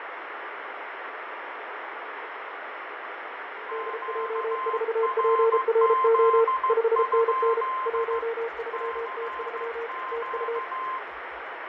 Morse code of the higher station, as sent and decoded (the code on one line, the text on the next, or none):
--.- .-. --.. ..--.. / -.-. --.-
QRZ? CQ